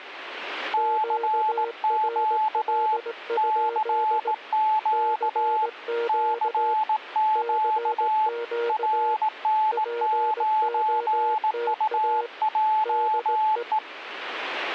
Morse code, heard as two keyed tones. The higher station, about 18 wpm, 870 Hz: CQ CQ CQ RN9UJE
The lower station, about 18 wpm, 470 Hz: QRL? CQ CQ POTA DE